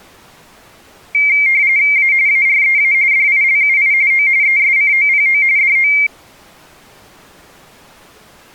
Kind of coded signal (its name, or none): RTTY